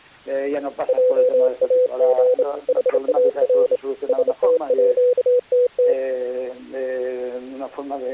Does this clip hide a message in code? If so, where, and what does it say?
Yes: Morse code (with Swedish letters) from 0.8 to 6.0 s, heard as a keyed tone, hand-sent with a straight key, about 27 wpm, 500 Hz. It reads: JAG HAR STÅTT